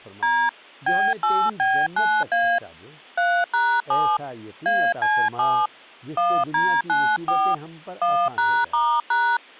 DTMF, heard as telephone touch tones, dialled by hand, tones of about 270 ms, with speech in Urdu. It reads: D B8B9A 3#7 AC7 1D94 1#*#